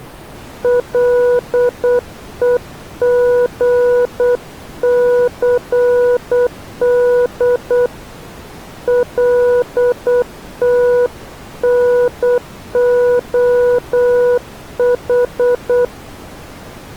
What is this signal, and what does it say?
Morse code, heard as a keyed tone, hand-sent with a paddle, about 8 wpm, 490 Hz. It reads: LEGCD LTNOH